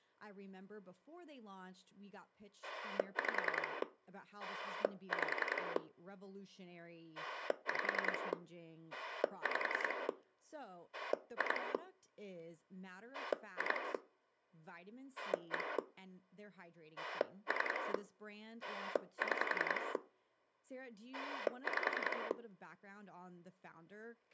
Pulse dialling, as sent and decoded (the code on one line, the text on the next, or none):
5 / 5 / 5 / 5 / 2 / 2 / 1 / 3 / 6 / 5
5 5 5 5 2 2 1 3 6 5